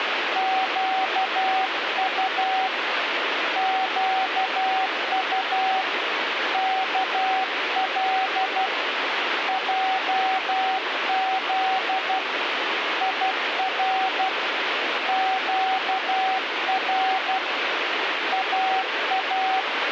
Morse code, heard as a keyed tone, hand-sent with a paddle, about 12 wpm, 760 Hz, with radio static. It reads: QU QU KL JZ IR QR AA